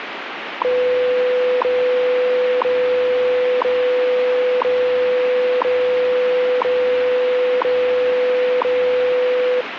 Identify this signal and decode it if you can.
Radio time signal (WWV, Colorado), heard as ticks, one a second, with radio static.